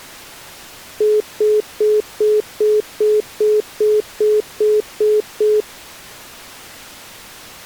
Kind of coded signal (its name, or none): telephone call progress tone